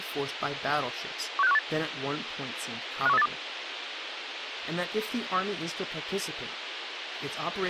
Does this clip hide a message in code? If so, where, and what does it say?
Yes: five-tone selective call (EEA) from 1.4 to 3.3 s, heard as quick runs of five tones, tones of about 40 ms, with radio hiss, a squelch burst at the end and speech in English. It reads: 16518 51382